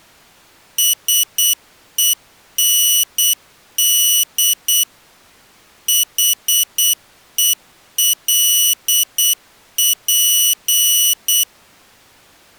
Morse code, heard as a high beeper, machine-sent, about 8 wpm, 2950 Hz. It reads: SEND HELP